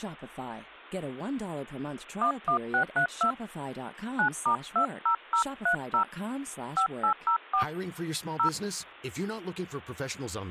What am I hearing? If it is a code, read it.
DTMF, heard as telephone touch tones, dialled by hand, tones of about 100 ms, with speech in English. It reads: 11632 9*20030 5804 0